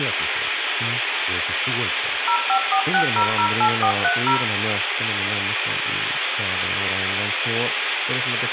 DTMF, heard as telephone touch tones, dialled by machine, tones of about 80 ms, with phone line noise, room echo and speech in Swedish. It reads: 0546008430